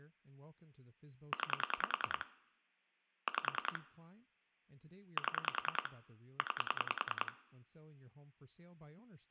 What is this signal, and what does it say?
Pulse dialling, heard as clicks on a phone line, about 10 pulses a second, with room echo and speech in English. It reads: 9 5 7 9